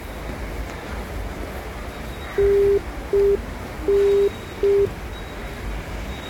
Telephone call progress tone (UK plan), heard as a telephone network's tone, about 400 Hz, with the noise of a subway station. Congestion tone.